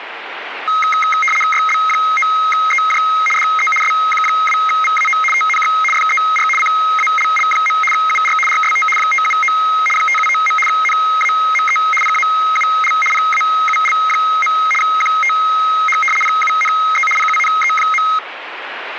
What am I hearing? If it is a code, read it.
RTTY (75 baud, 850 Hz shift), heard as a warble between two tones, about 1700 Hz centre, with radio static. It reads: YB9EJ DE SQ2VAO TNX FER CALL. UR RST 579 579. NAME PAUL PAUL. QTH PUNE PUNE.